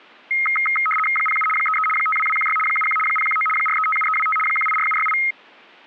RTTY (75 baud, 850 Hz shift), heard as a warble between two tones, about 1700 Hz centre. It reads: 07 33 52216 71 019 4357325 184768